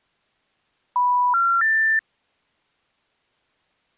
Telephone call progress tone (North American plan), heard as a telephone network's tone, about 980, 1370, 1800 Hz. Special information tone.